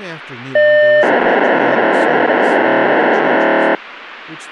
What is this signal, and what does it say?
POCSAG pager data (1200 baud), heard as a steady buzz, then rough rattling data, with radio hiss and speech in English.